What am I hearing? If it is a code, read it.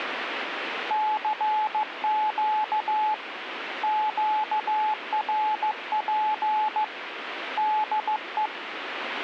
Morse code, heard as a keyed tone, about 15 wpm, 860 Hz, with radio static. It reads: CQ QRP DE